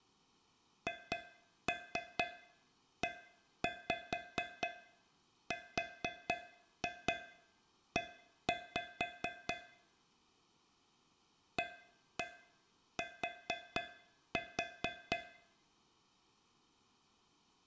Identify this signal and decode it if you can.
Tap code, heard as taps on a metal pipe, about 4 knocks a second. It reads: HERE AT